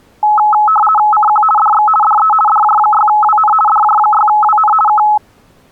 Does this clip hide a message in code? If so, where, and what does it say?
Yes: RTTY (50 baud, 450 Hz shift) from 0.2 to 5.2 s, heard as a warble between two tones, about 1070 Hz centre. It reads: CQ DX DE DJ6WN DJ6WN K